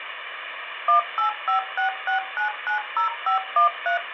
DTMF, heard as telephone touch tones, dialled by machine, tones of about 120 ms, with phone line noise. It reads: 18566990513